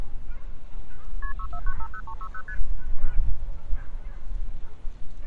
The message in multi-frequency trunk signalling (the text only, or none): KP 64950360 ST